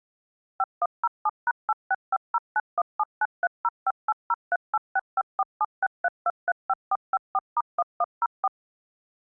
DTMF, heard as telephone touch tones, dialled by machine, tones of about 40 ms. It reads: 5107#865091793058038654763235454*1104